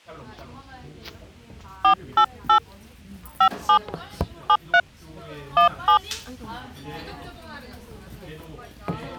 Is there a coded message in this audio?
Yes: DTMF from 1.8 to 6.0 s, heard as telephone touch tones, dialled by hand, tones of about 90 ms, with the noise of a crowd indoors. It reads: 488 57 73 17